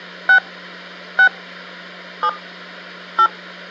DTMF, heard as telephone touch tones, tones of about 80 ms, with hum. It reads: 6 6 7 8